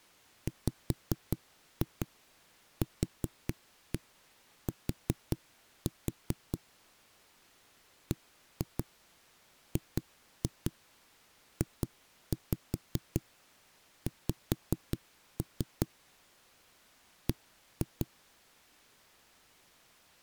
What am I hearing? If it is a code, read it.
Tap code, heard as knocks on a wall, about 5 knocks a second. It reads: WQT BGJX B